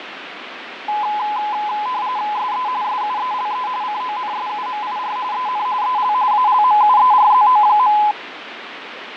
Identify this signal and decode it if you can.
RTTY (45.45 baud, 170 Hz shift), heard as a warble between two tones, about 930 Hz centre, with radio static and fading. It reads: SE SUELE CONSUMIR EN EL ALMUERZO.